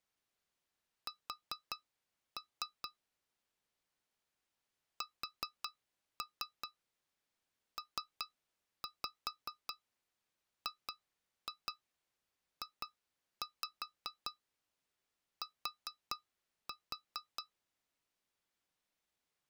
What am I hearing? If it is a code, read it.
Tap code, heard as taps on glass, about 5 knocks a second. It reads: S SPGJT